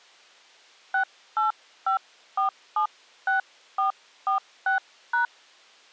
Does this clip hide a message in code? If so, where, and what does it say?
Yes: DTMF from 0.9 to 5.3 s, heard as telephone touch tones, dialled by hand, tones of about 120 ms. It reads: 685476446#